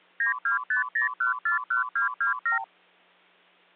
Multi-frequency trunk signalling (R2, with the far end's replies), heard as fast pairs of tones, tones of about 120 ms. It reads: 9250141227